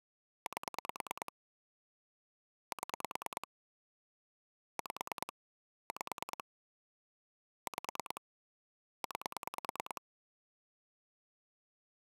Pulse dialling, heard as clicks on a phone line, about 9 pulses a second. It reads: 8 7 5 5 5 9